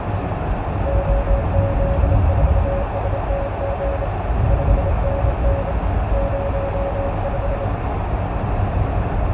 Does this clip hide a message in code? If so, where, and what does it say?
Yes: Morse code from 0.8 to 7.7 s, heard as a keyed tone, hand-sent with a bug key, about 27 wpm, 560 Hz, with heavy radio static, a narrow filter and the noise inside a car. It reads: OZ4STG 5NN 05